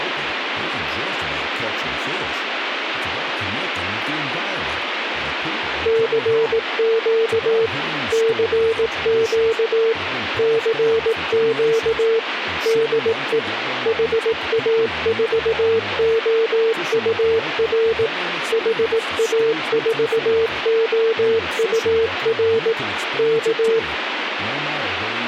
Morse code, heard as a keyed tone, machine-sent, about 18 wpm, 450 Hz, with radio static and speech in English. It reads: CQ CQ CQ DE HA4OUR HA4OUR K